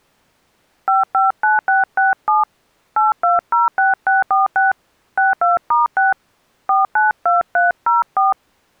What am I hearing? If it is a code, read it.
DTMF, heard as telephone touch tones, dialled by hand, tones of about 160 ms. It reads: 559667 8206646 62*6 492304